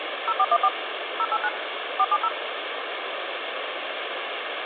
DTMF, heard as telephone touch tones, dialled by machine, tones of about 50 ms, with phone line noise. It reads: 0414 089 470